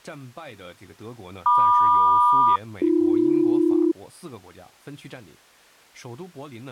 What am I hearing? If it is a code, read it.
Aircraft SELCAL, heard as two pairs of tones, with speech in Chinese. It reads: MQ-AB